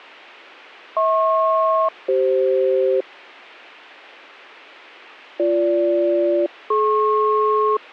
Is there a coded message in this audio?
Yes: aircraft SELCAL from 1.0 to 7.8 s, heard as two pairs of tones. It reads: HP-CF BG-DP